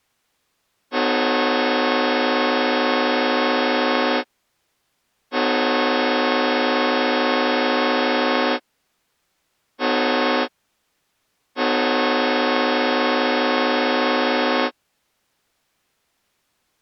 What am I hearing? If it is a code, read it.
Train horn signal, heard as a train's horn. 2 long, 1 short, 1 long. On North American railways: approaching a public crossing.